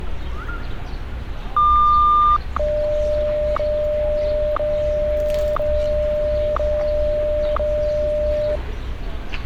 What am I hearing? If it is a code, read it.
Radio time signal (WWVH, Hawaii), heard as ticks, one a second, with street noise.